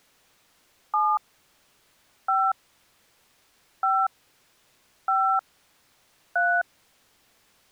DTMF, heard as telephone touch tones, dialled by hand, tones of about 260 ms. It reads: 7 5 5 5 3